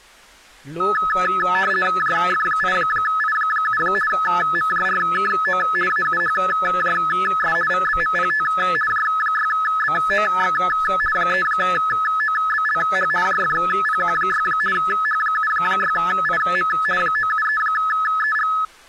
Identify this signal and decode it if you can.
RTTY (50 baud, 450 Hz shift), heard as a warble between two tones, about 1500 Hz centre, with speech in Maithili. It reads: JF8I7 MJRKO AUHJS VBMPT J6BOX 3OBLH JFPQ6 H76IM 973EG